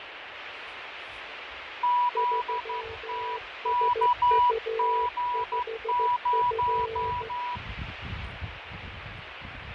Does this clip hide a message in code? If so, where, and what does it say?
Yes: Morse code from 1.8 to 7.6 s, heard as two keyed tones, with radio static, fading and the noise of a park. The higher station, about 12 wpm, 980 Hz: ZTKG0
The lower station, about 14 wpm, 450 Hz: 3SU5F